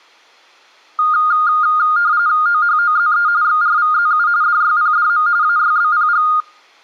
RTTY (45.45 baud, 170 Hz shift), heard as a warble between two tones, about 1320 Hz centre. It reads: OHOZE XRVZU DYPDM AYBPG